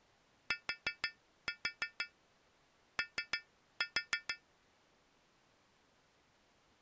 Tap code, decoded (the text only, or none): TO